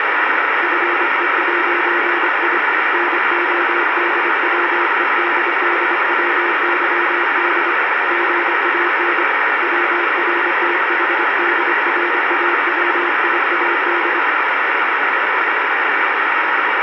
Morse code, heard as a keyed tone, hand-sent with a paddle, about 25 wpm, 350 Hz, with heavy radio static. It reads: FE'I NODWEDDWYD GAN WRTHDRAWIAD